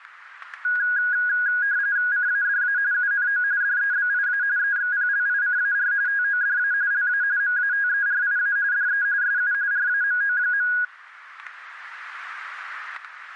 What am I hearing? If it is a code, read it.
RTTY (45.45 baud, 170 Hz shift), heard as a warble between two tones, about 1550 Hz centre, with static crashes. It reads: CADA UNO DEBIA EXPLICAR TODA LA MATERIA DE SU RAMO.